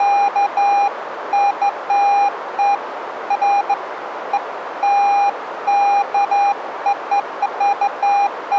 Beeps of irregular length, with radio static. There is no code.